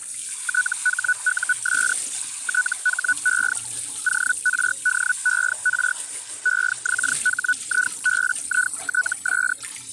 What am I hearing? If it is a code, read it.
Hellschreiber (Feld-Hell, 122.5 baud), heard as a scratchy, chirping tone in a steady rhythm, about 1480 Hz, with kitchen noise. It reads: THUS THE ORDER EXHIBITS